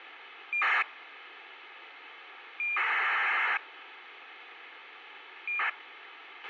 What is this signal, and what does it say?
ACARS aircraft data, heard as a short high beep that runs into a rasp, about 2400 baud, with radio hiss and a squelch burst at the end.